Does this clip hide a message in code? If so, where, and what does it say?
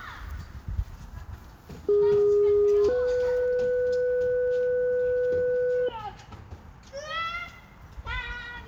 Yes: two-tone page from 1.9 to 5.9 s, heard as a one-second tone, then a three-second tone, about 410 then 500 Hz, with the noise of a park.